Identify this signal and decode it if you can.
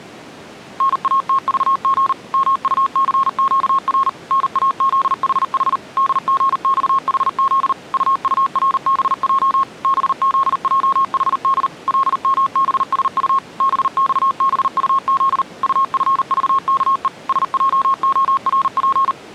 Morse code, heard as a keyed tone, machine-sent, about 39 wpm, 1080 Hz. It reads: NATVG MUCQR NAZHH DGXHZ UURBJ BZJHD LMBSU BXBUZ UFVKE SJORP